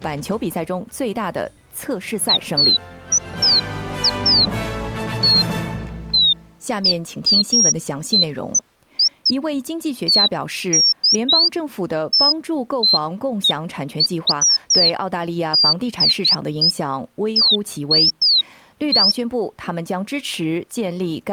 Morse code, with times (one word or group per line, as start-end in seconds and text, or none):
none